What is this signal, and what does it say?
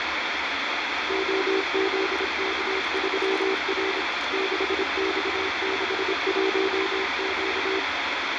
Morse code, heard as a keyed tone, machine-sent, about 26 wpm, 380 Hz, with heavy radio static and the noise of a restaurant. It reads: OZK3R 6X61Q